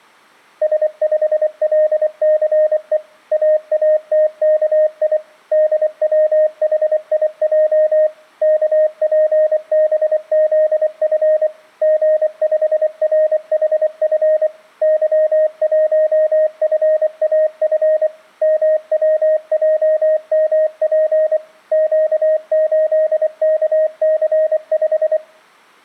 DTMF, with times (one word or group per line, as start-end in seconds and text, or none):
none